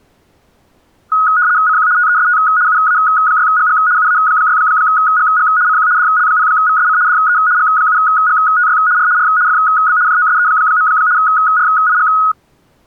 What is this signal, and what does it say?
RTTY (75 baud, 170 Hz shift), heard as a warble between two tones, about 1360 Hz centre. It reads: CQ TEST UA6GG UA6GG CQ DL0VSC DE G7GTY R R FB JOSE. RIG